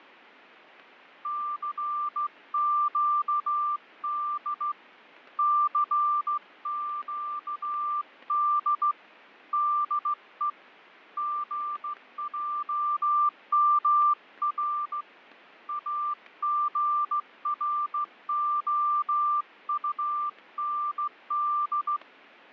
Morse code, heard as a keyed tone, hand-sent with a straight key, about 15 wpm, 1180 Hz, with fading. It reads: CQD CQD DE GJMR AGROUND